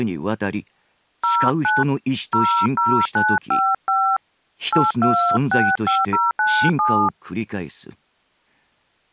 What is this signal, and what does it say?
DTMF, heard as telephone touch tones, dialled by hand, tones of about 270 ms. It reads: 09 00955 8265097